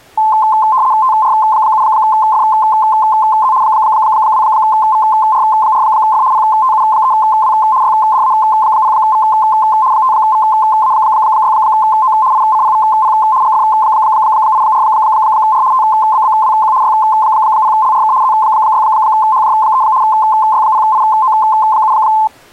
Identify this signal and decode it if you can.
RTTY (75 baud, 170 Hz shift), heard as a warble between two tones, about 960 Hz centre. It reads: TR7FZ 2VR4F PTU3W YDA0V 5VA6O ICPVP GF84R TBBWQ Y0LRK Z6HJ3 Y0IO7